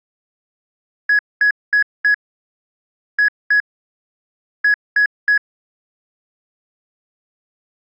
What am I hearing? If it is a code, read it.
Beep code, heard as beeps, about 1700 Hz. 4-2-3. In Phoenix BIOS tables: gate A20 failure.